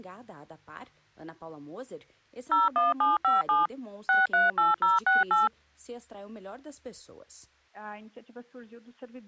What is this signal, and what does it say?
DTMF, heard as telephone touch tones, dialled by machine, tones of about 170 ms. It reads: 01757 638068